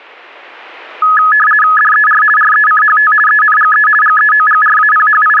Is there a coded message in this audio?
Yes: RTTY (50 baud, 450 Hz shift) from 1.0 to 5.4 s, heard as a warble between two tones, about 1480 Hz centre. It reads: DER RECHT ENGE …